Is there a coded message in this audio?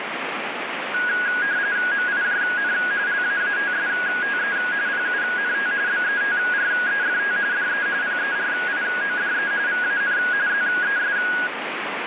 Yes: RTTY (45.45 baud, 170 Hz shift) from 0.9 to 11.5 s, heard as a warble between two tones, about 1550 Hz centre, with radio static. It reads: MIJN LAATSTE PUNT BETREFT DE PERIODE VAN ZES